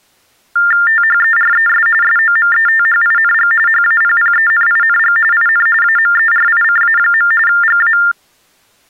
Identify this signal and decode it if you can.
TTY/TDD text telephone tones (45.45 baud Baudot), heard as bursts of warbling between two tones, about 400 Hz shift, 1600 Hz centre. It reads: THERES SOMETHING HAPPENING IN AMERICA. GA